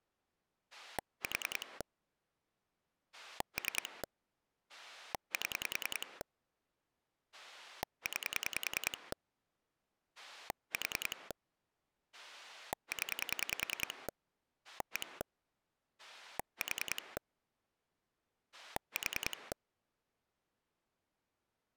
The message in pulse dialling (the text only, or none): 4 3 7 9 4 0 1 4 4